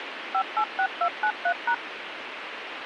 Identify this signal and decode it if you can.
DTMF, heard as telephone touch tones, dialled by machine, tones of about 80 ms, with radio hiss. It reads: 586293#